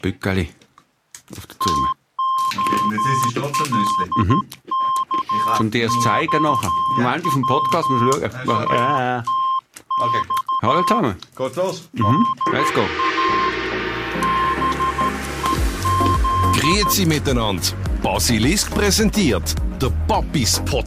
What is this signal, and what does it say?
Morse code (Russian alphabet), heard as a keyed tone, hand-sent with a paddle, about 13 wpm, 1060 Hz. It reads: ТОЛКОВАТЬ ДА БЕЗ